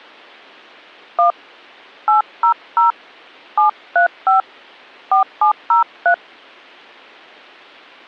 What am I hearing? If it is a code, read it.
DTMF, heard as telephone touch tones, dialled by hand, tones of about 110 ms. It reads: 1 800 735 4703